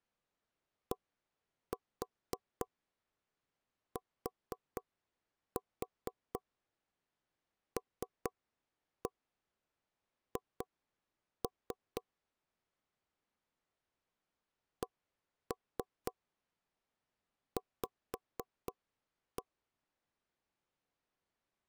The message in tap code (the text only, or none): DTLH CV